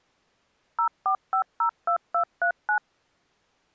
DTMF, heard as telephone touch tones, dialled by machine, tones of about 90 ms. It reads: 04502239